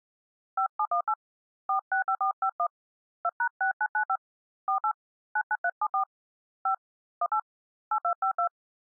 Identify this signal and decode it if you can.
DTMF, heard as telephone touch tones, dialled by hand, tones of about 80 ms. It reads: 5718 465451 2#6995 48 99374 5 18 8252